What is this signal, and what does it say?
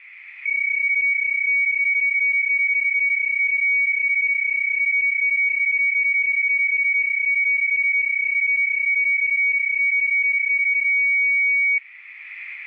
PSK31 (31.25 baud), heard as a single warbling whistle, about 2250 Hz.